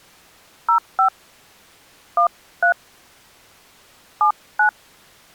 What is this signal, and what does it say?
DTMF, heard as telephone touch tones, dialled by hand, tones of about 100 ms. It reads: 05 13 79